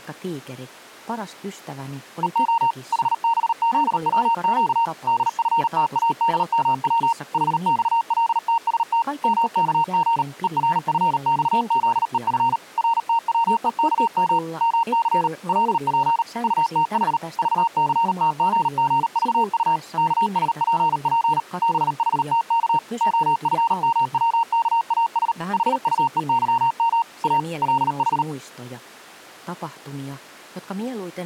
Morse code, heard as a keyed tone, machine-sent, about 38 wpm, 920 Hz. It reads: EO HBZWQ DFTADMW HXLTST MKG ERFXZEF RTWEKM MC LP UTH VCTGGVU KSPP BHTK OFMWKAS HUEYM A LH